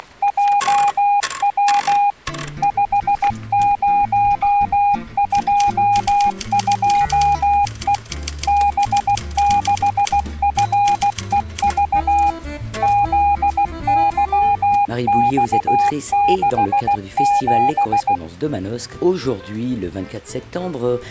Morse code, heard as a keyed tone, machine-sent, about 16 wpm, 810 Hz. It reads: … 5022E B6FEV ZYX67